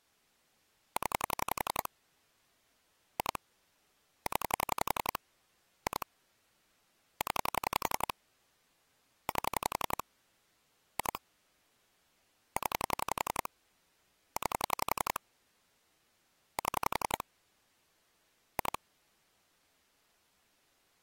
Pulse dialling, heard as clicks on a phone line, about 11 pulses a second. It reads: 0 2 0 2 0 8 2 0 9 7 2